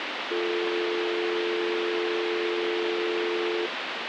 Telephone call progress tone (North American or UK plan), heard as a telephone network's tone, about 350, 440 Hz, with phone line noise. Dial tone.